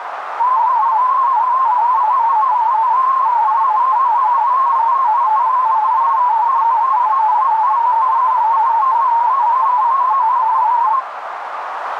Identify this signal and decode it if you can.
Multi-tone FSK (Olivia or MFSK type), about 250 Hz wide, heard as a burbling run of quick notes, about 31.25 baud, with radio static and a narrow filter.